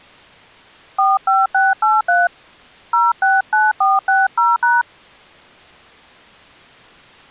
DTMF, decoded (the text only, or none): 45683 069460#